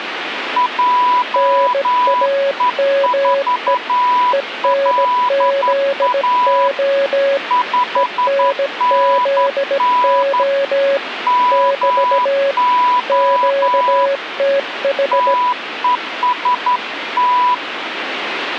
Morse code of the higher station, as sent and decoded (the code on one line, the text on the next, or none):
.--- . ....- .-.. .- / ..... -. -. / -- --- / - . ... -
JE4LA 5NN MO TEST